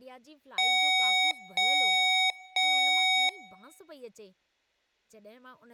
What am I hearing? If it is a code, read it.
Beep code, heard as beeps from a small speaker, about 750 Hz, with room echo and speech in Sindhi. 3 long. In IBM BIOS tables: keyboard card error.